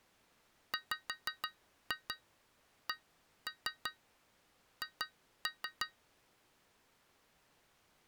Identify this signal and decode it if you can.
Tap code, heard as taps on glass, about 6 knocks a second. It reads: WCH